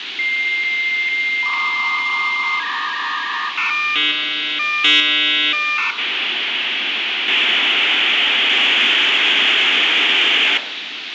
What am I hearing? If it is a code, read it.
Dial-up modem handshake (V.34 or later), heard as a whistle, warbles, then hiss, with phone line noise and room echo.